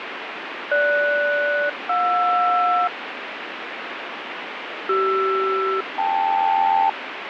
Aircraft SELCAL, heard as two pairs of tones, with radio static. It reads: GS-JR CR-KL